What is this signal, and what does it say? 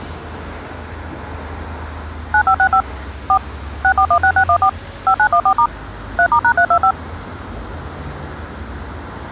DTMF, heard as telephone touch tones, dialled by machine, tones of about 80 ms, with street noise. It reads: 9565 4 6416614 5914* 3*#325